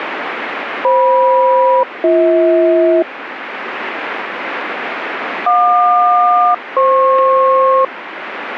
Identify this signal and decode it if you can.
Aircraft SELCAL, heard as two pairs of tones, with radio static. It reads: FM-BH JQ-FP